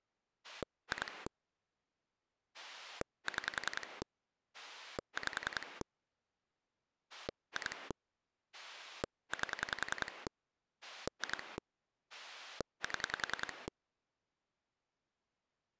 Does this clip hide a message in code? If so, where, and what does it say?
Yes: pulse dialling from 0.4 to 13.7 s, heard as a rotary dial, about 10 pulses a second. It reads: 2 6 5 2 8 2 7